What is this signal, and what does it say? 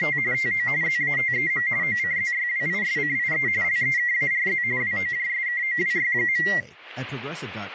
RTTY (45.45 baud, 170 Hz shift), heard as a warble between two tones, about 2000 Hz centre, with speech in English. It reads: … TO ZATEM OCZYWISCIE LEKARZ WOJSKOWY.